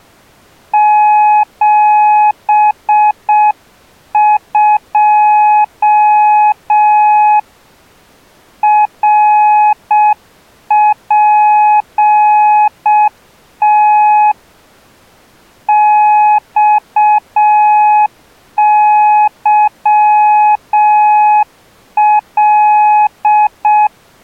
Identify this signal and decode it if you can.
Morse code, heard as a keyed tone, hand-sent with a paddle, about 6 wpm, 840 Hz. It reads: 72 RPT XYL